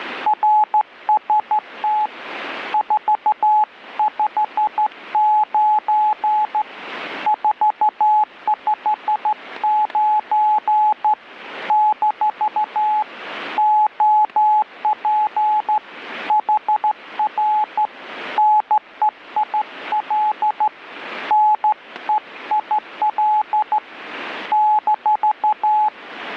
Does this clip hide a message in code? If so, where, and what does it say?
Yes: Morse code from 0.2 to 25.9 s, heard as a keyed tone, hand-sent with a straight key, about 13 wpm, 850 Hz, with static crashes. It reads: RST 459 459 - OP HR NEIL NEIL -